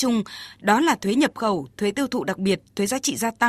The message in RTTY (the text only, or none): none